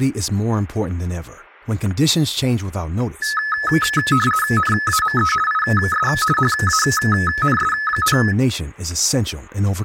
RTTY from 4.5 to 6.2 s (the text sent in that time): NAME IS